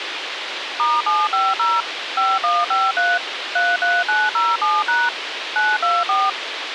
DTMF, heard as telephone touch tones, dialled by machine, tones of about 210 ms, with radio hiss. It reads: *750 5153 33907# 924